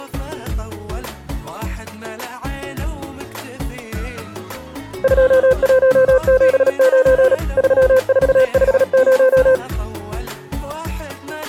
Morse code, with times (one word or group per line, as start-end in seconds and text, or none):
5.0-7.3 2179
7.6-9.6 3450